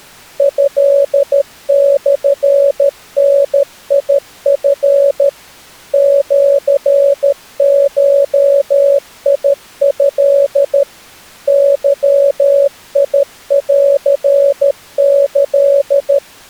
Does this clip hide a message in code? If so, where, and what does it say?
Yes: Morse code (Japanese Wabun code) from 0.3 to 16.2 s, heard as a keyed tone, machine-sent, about 13 wpm, 560 Hz. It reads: トモダチ シゴト ゲンキ